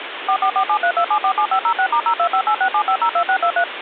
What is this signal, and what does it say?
DTMF, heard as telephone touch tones, dialled by machine, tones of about 80 ms, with phone line noise. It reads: 444732747506*025867502623